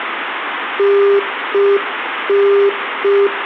Telephone call progress tone (UK plan), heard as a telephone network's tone, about 400 Hz, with phone line noise. Congestion tone.